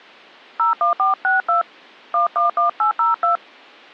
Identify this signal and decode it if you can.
DTMF, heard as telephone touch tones, dialled by hand, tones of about 120 ms. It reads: 01462 111802